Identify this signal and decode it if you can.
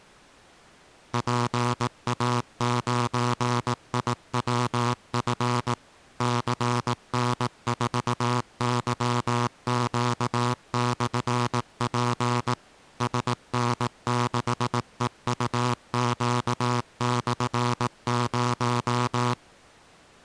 Morse code, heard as a buzzer, machine-sent, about 18 wpm. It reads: PA9IWF CN4YQ/P SN6EUQ/0